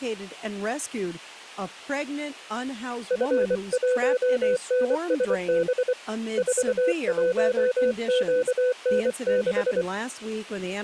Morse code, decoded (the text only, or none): F1NSB 41QN6